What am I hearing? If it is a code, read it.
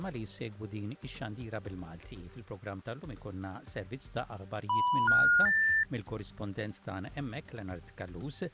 Telephone call progress tone (North American plan), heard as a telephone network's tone, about 980, 1430, 1800 Hz. Special information tone.